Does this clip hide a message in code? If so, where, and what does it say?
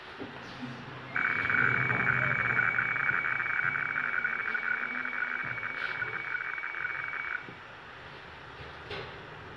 Yes: weather fax (radiofax), 120 lines a minute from 1.2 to 7.4 s, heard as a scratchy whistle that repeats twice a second, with radio static, room echo and the noise inside a lift.